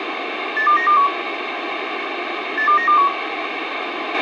Five-tone selective call (CCIR), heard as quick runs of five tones, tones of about 100 ms, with radio hiss, a squelch burst at the end and room echo. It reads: 82921 82921